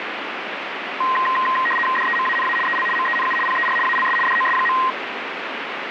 RTTY (75 baud, 850 Hz shift), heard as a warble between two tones, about 1460 Hz centre, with radio static. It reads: DEMANA EL MENU PER ALS DOS.